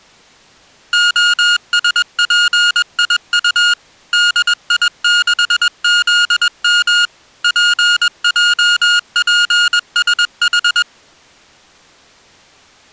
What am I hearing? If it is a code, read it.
Morse code, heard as electronic beeps, machine-sent, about 21 wpm, 1430 Hz. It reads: OSPIU DI6ZM PJPSH